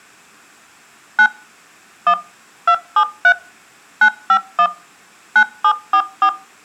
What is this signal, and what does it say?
DTMF, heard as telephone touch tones, dialled by machine, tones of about 70 ms. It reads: 9 1 273 951 9744